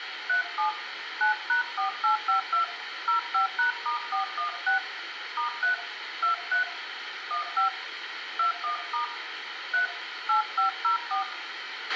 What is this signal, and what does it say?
DTMF, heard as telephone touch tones, dialled by hand, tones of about 120 ms, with radio hiss, a squelch burst at the end and room echo. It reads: 37 9#4852 05#*416 *3 23 15 21* 3 8504